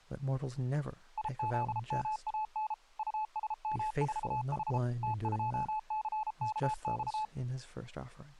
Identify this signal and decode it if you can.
Morse code, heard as a keyed tone, machine-sent, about 33 wpm, 860 Hz, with speech in English. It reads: IZMAN USM4H T2CKX